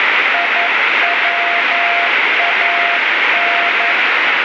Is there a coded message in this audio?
Yes: Morse code (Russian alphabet) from 0.3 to 4.0 s, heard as a keyed tone, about 11 wpm, 690 Hz, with heavy radio static. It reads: ИВАН